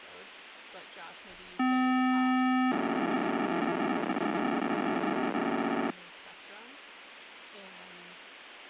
POCSAG pager data (512 baud), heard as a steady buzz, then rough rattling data, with radio hiss and speech in English.